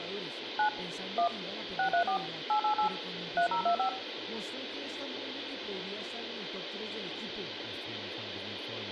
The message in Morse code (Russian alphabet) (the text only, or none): none